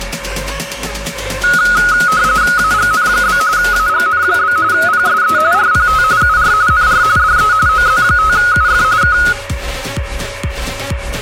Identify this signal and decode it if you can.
RTTY (45.45 baud, 170 Hz shift), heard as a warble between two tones, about 1360 Hz centre, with radio static and a steady whistle near 560 Hz. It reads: AGN? AGN? PSE RPT UR NR DE OZ5UF K